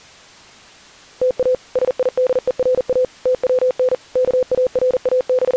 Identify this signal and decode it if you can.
Morse code (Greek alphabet), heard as a keyed tone, machine-sent, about 40 wpm, 510 Hz. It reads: ΤΑ ΣΙΔΕΡΑ ΤΩΝ …